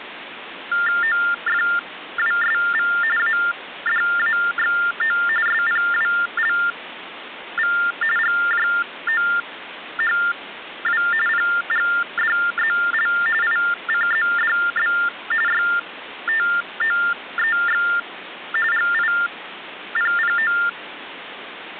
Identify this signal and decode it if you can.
TTY/TDD text telephone tones (45.45 baud Baudot), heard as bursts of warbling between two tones, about 400 Hz shift, 1600 Hz centre, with phone line noise. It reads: OFWSV ADAXO SPWLV GJOHW PGDZL ICZDB YTOEX GIPPO